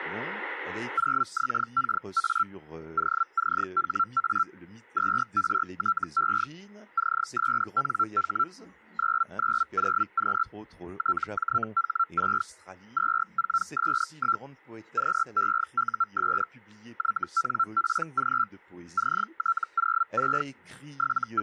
Hellschreiber (Feld-Hell, 122.5 baud), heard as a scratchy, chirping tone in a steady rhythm, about 1350 Hz. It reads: 0XKA OCHA 2RTE CSNH 990Q TJH6 24S1 QEUS YNPG CT06 …